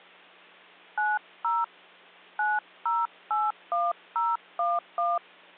DTMF, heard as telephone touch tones, dialled by hand, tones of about 200 ms, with hum. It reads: 90 9081011